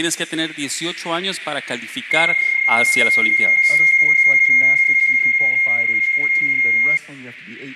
PSK31 (31.25 baud), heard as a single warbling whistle, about 2150 Hz, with radio static.